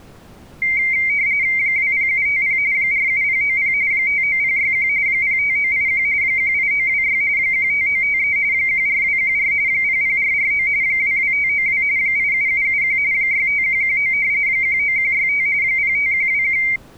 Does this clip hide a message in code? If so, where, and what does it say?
Yes: RTTY (45.45 baud, 170 Hz shift) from 0.6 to 16.8 s, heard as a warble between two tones, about 2200 Hz centre. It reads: 20750 47090 59061 05981 18926 15953 14214 00449 22592 87771 65119 19165 05121